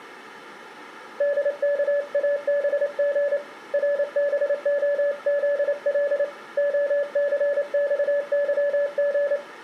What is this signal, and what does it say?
Morse code, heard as a keyed tone, hand-sent with a paddle, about 28 wpm, 570 Hz, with room echo. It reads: DKABG RBOZL OCXYG